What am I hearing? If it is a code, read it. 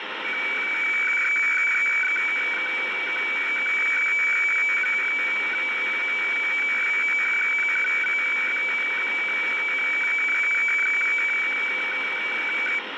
Weather fax (radiofax), 120 lines a minute, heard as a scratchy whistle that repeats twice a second, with heavy radio static.